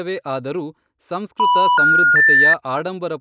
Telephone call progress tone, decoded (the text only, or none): special information tone